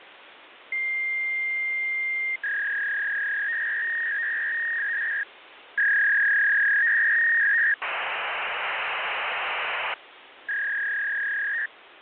Fax machine handshake, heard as a long tone, a warble and hiss, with phone line noise.